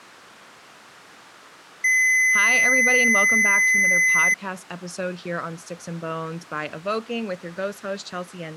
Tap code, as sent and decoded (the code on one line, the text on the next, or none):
none